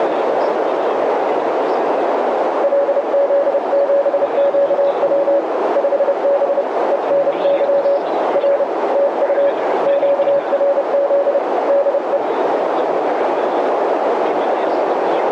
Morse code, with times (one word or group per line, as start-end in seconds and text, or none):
2.6-5.4 LZ7QW
5.8-6.6 5B
6.9-8.0 ENY
8.4-8.6 R
8.9-9.5 TU
9.9-11.4 QRZ
11.7-12.2 DE